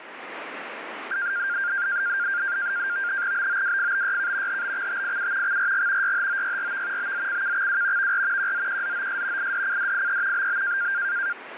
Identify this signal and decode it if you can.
NAVTEX (SITOR-B), 100 baud, 170 Hz shift, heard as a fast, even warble, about 1500 Hz centre, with radio static. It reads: BOWFBYK HBXTIU XRG YHOYRV BZCKXW VR QZQZOS IDCDIE BB